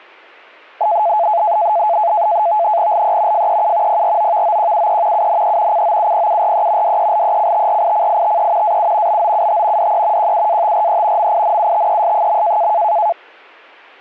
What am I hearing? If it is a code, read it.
NAVTEX (SITOR-B), 100 baud, 170 Hz shift, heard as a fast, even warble, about 770 Hz centre. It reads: LE FEU PROVOQUE UNE COUPURE DELECTRICITE AU BOUT DE QUATRE MINUTES.